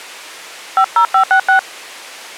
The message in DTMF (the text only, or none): 50566